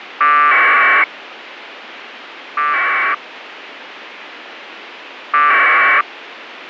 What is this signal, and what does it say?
Packet radio (AX.25, as in APRS), 1200 baud, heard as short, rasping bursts, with radio hiss.